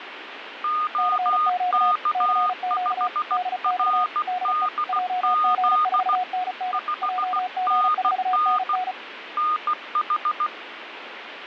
Morse code, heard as two keyed tones, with radio static. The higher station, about 16 wpm, 1230 Hz: OK5RDZ 5NN NH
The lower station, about 35 wpm, 730 Hz: CQ CQ DX DE JG4NN JG4NN